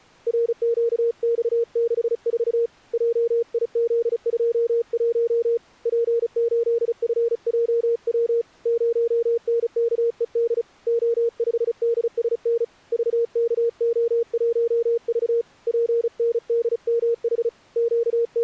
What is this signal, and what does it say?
Morse code, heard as a keyed tone, hand-sent with a paddle, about 35 wpm, 470 Hz. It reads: RQX64 JIZ21 P8FJW 0NKED O5DSN VKO1V PNDMH …